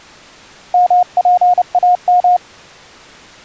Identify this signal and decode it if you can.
Morse code (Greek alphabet), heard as a keyed tone, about 30 wpm, 720 Hz. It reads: ΜΠΑΜ